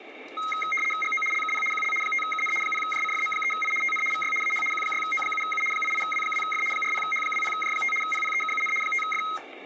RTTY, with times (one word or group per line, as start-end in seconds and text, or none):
1.0-1.2 GO
1.3-1.6 LKP
1.7-1.9 QL
2.0-2.5 5KN
2.6-3.7 0JCFM3I
3.8-4.0 TN
4.1-4.3 VY
4.4-4.6 AH
4.7-5.6 Q6O7U
5.7-6.6 88W2F
6.7-7.9 40H20J5
8.0-8.7 PPEKUN
8.8-9.2 5F